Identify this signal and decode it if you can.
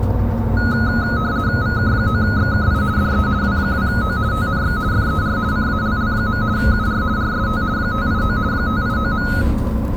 RTTY (50 baud, 170 Hz shift), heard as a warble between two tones, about 1360 Hz centre, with the noise inside a bus. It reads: VK9XKI DE W2O TNX FER CALL. UR RST 589 589.